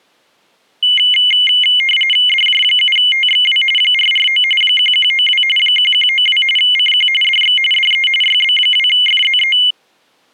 RTTY (45.45 baud, 850 Hz shift), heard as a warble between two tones, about 2550 Hz centre. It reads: DJ7TXW 449 1192 1192 CQ DX DE YB2FZE